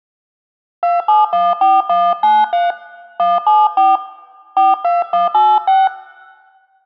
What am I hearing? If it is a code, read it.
DTMF, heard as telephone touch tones, dialled by hand, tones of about 190 ms, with room echo. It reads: 2714193 174 42186